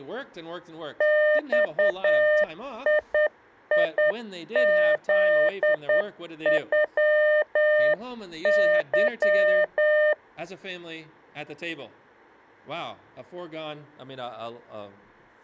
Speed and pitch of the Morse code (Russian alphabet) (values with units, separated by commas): 9 wpm, 600 Hz